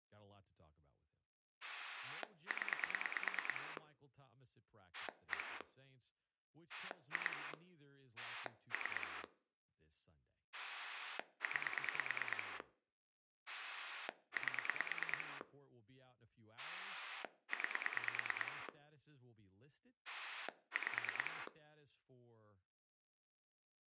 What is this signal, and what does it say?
Pulse dialling, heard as a rotary dial, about 9 pulses a second, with speech in English. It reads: 0 1 2 3 9 8 9 5